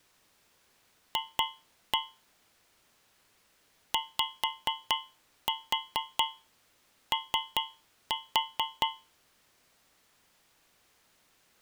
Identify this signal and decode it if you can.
Tap code, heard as taps on a metal pipe, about 4 knocks a second. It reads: F YO